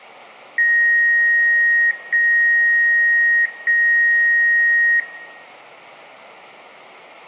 Beep code, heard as beeps from a small speaker, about 1900 Hz, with room echo. 3 long. In IBM BIOS tables: keyboard card error.